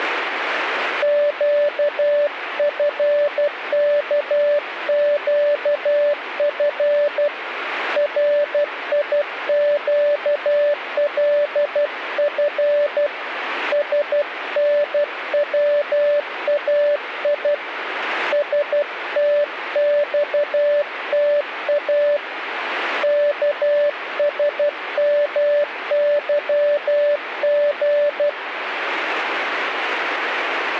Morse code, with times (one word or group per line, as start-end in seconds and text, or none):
1.0-7.3 QFKQF
8.0-13.1 RIQLF
13.7-17.5 SNWAI
18.3-22.2 STXTA
23.0-28.3 KSMYG